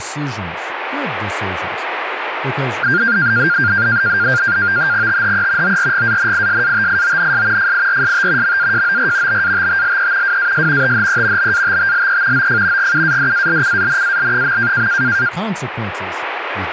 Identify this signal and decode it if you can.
NAVTEX (SITOR-B), 100 baud, 170 Hz shift, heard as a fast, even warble, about 1500 Hz centre, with radio static and speech in English. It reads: THE ORGANISATIONS FIRST MAJOR BATTLE WAS THE BATTLE OF GUADALCANAL.